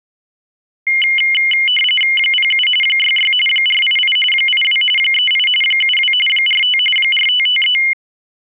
RTTY (45.45 baud, 850 Hz shift), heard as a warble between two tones, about 2550 Hz centre. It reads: 07 66 488 82 38 72 45 4553